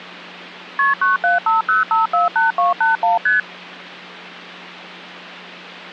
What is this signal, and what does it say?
Multi-frequency trunk signalling (R1, as on North American trunks), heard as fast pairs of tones, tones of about 150 ms, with hum. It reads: KP 9750548281 ST